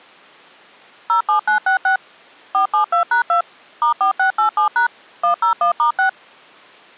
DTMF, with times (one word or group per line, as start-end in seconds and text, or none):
1.1-2.0 07966
2.5-3.4 472#2
3.8-4.9 *4687#
5.2-6.1 101*6